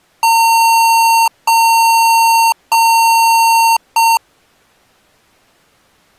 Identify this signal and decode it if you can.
Beep code, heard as beeps from a small speaker, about 910 Hz. 3 long, 1 short.